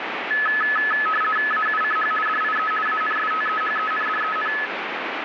RTTY (50 baud, 450 Hz shift), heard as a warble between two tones, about 1500 Hz centre, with radio static. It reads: AUCH DIE ANSTEHENDEN